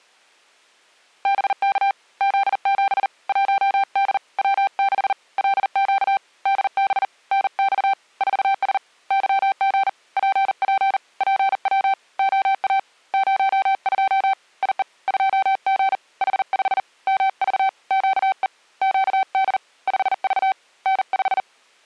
Morse code, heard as a keyed tone, hand-sent with a paddle, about 40 wpm, 780 Hz. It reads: BK Z7 1D W6 LQ DB NX 4S YG PP PW OA 02 IE 2G H5 MV QE QD 5V N5